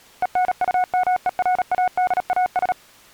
Morse code, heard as a keyed tone, machine-sent, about 37 wpm, 730 Hz. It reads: ENUMERADAS